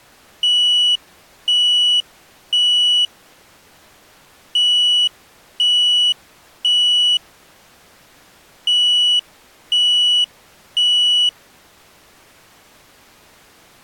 Alarm pattern, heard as an alarm's beeps, played three times, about 2950 Hz. Temporal three. Smoke or fire, evacuate.